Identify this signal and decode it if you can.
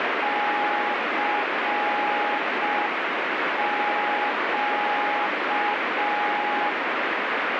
Morse code, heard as a keyed tone, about 5 wpm, 830 Hz, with heavy radio static. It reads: CQ